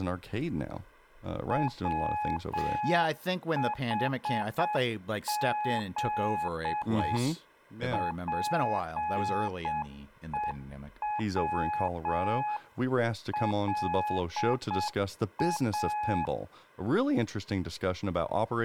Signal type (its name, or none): Morse code